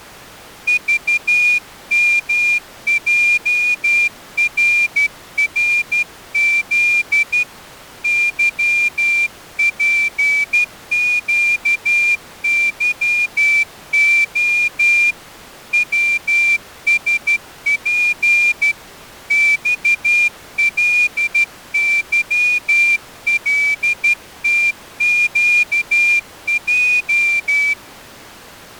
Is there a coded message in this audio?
Yes: Morse code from 0.6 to 27.8 s, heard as a whistle, hand-sent with a straight key, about 12 wpm. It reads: VMJRRZ YPQYO WSP XLYLTQJ